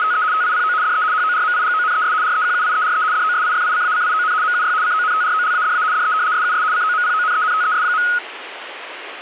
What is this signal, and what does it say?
RTTY (75 baud, 170 Hz shift), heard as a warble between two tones, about 1360 Hz centre, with radio static. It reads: … TIPO DE HORMIGONES REQUIERE DOSIFICACION MUY CONTROLADA DE SUS COMPONENTES.